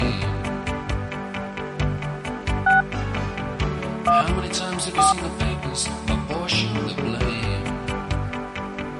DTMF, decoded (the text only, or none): 6 1 4